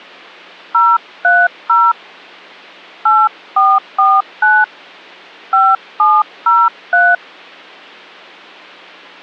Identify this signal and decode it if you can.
DTMF, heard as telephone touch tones, dialled by hand, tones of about 220 ms. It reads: 030 8449 5703